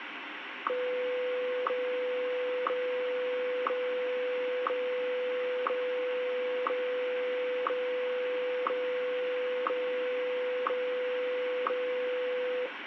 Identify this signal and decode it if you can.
Radio time signal (WWVH, Hawaii), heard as ticks, one a second, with radio static.